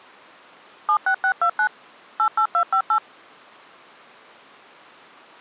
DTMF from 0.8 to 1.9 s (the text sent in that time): 76629